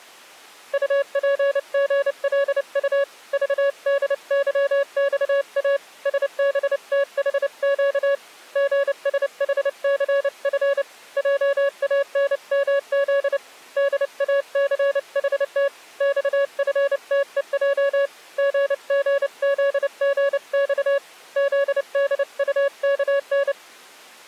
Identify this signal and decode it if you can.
Morse code, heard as a keyed tone, hand-sent with a paddle, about 29 wpm, 560 Hz. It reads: UPGLU VDYXA SBTHQ GSHCF JANMZ DACHT XFTEJ GGZGX ZDUKN